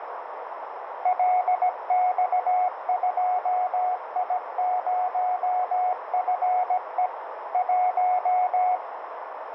Morse code, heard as a keyed tone, machine-sent, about 17 wpm, 730 Hz, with radio static and a narrow filter. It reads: LX2I0FE 1